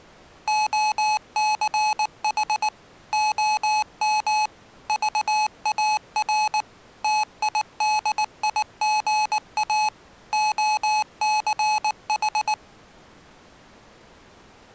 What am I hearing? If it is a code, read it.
Morse code, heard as electronic beeps, machine-sent, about 19 wpm, 850 Hz. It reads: OCH OM VAR TIDIGA OCH